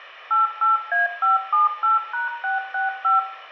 DTMF, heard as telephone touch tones, dialled by machine, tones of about 150 ms, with room echo. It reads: 88A578#665